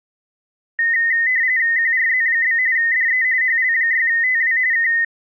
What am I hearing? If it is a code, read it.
RTTY (45.45 baud, 170 Hz shift), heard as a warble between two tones, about 1950 Hz centre. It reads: QRZ? DE HL6TW K